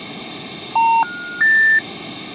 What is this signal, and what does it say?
Telephone call progress tone (North American plan), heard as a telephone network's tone, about 910, 1430, 1800 Hz. Special information tone.